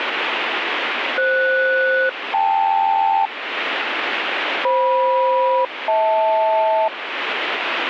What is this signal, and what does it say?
Aircraft SELCAL, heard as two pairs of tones, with radio static. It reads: FS-KL FM-HL